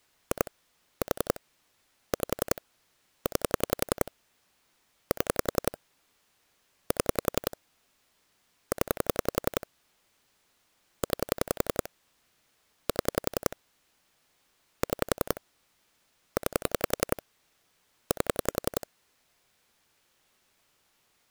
Pulse dialling, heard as clicks on a phone line, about 11 pulses a second. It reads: 2 4 5 9 7 7 0 9 7 6 9 8